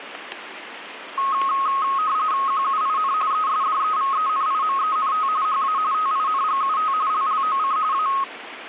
RTTY (45.45 baud, 170 Hz shift), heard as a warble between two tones, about 1180 Hz centre, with radio static and static crashes. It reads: QUIN ESDEVENIMENT HA TINGUT LLOC A